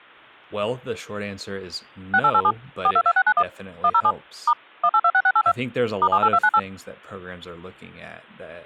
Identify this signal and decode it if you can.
DTMF, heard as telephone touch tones, dialled by machine, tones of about 60 ms, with speech in English. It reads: 6887 422691 107 * 1826682 *78298